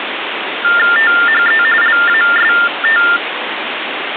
TTY/TDD text telephone tones (45.45 baud Baudot), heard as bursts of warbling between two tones, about 400 Hz shift, 1600 Hz centre, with phone line noise. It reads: THE LAST